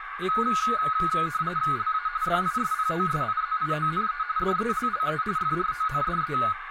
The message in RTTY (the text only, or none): LA DISPOSIZIONE DELLE FRONDE